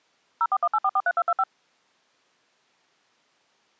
DTMF, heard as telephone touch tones, dialled by machine, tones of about 50 ms. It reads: 0418443225